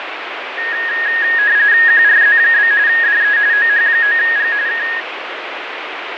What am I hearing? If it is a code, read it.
RTTY (45.45 baud, 170 Hz shift), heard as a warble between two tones, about 1750 Hz centre, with radio static and fading. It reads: QRZ? DE OH9G K